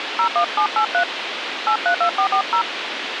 DTMF, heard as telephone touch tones, dialled by hand, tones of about 90 ms, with radio hiss. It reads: 01783 832440